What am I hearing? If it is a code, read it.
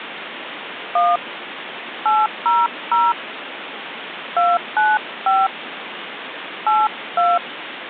DTMF, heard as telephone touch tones, dialled by hand, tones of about 210 ms, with phone line noise. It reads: 1 800 295 82